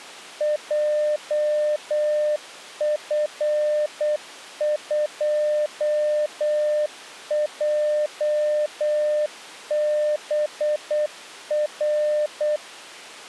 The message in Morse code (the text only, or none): JF2JBR